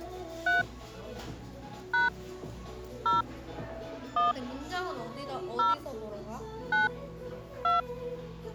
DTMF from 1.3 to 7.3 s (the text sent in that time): # 0 1 0 9